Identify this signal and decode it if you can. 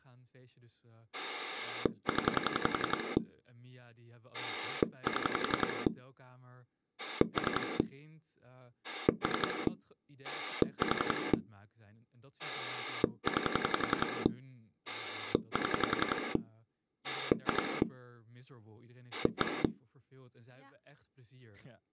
Pulse dialling, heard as a rotary dial, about 11 pulses a second, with speech in Dutch. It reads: 0 7 3 3 4 9 7 2 1